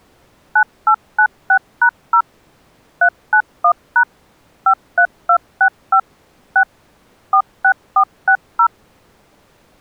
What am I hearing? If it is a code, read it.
DTMF, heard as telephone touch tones, dialled by machine, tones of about 80 ms. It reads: 9896#0 391# 53265 6 46460